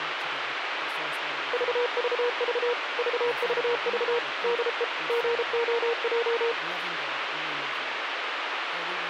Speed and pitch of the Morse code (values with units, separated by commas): 33 wpm, 480 Hz